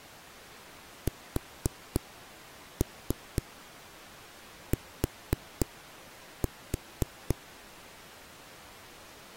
Tap code, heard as knocks on a wall, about 4 knocks a second. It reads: ST